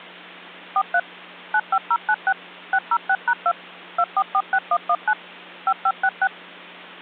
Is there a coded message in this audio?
Yes: DTMF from 0.8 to 6.3 s, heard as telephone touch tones, dialled by machine, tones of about 60 ms, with hum. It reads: 43 95096 606#2 2446119 5566